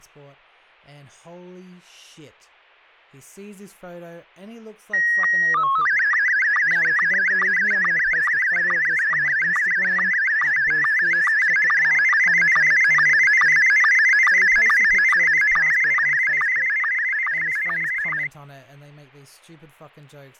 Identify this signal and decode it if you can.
SSTV (slow-scan television), Scottie S1, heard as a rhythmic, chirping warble, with fading and speech in English.